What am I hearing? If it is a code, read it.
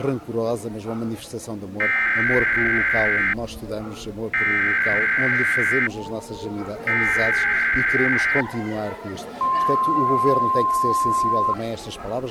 Emergency Alert System (SAME) tones (header bursts, then the 1050 Hz attention tone), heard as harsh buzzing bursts, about 520.83 baud.